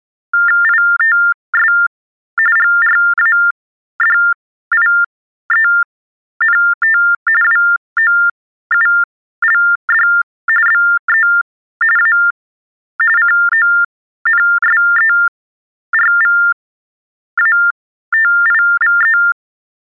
TTY/TDD text telephone tones (45.45 baud Baudot), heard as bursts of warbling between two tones, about 400 Hz shift, 1600 Hz centre. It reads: ITS GRADIENT WOULD BE A CONSERVATIVE